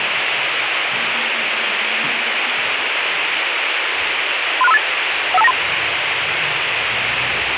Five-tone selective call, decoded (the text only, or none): 36358 15293